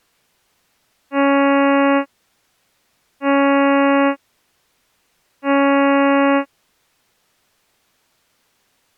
Ship horn signal, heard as a ship's horn, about 280 Hz. 3 short. At sea: I am operating astern propulsion.